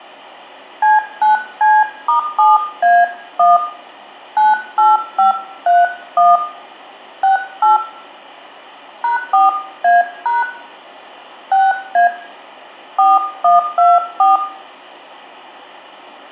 DTMF, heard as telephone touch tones, dialled by hand, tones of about 160 ms, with room echo. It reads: C9C*7A1 98531 68 #4A# 6A 4124